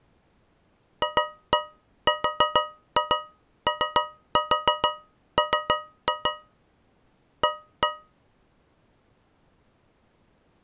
Tap code, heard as taps on a metal pipe, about 6 knocks a second. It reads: FROM A